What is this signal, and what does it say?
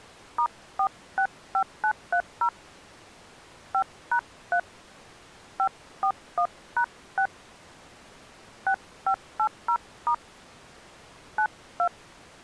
DTMF, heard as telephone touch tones, dialled by hand, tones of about 80 ms. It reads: *465930 5#3 541#6 6580* 92